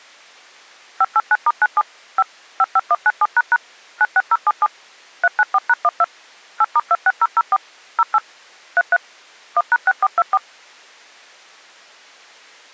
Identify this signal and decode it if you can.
DTMF, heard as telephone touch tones, dialled by machine, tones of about 40 ms. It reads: 589*97 5 55197## 96077 394#12 8*26004 08 33 1#6424